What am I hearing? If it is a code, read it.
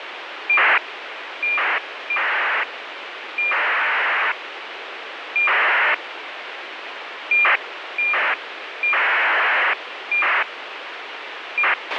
ACARS aircraft data, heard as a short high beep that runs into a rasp, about 2400 baud, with radio hiss and a squelch burst at the end.